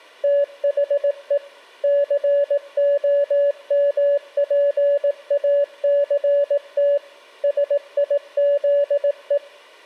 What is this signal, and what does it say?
Morse code, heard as a keyed tone, machine-sent, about 18 wpm, 570 Hz. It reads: THE COMPACT SIZE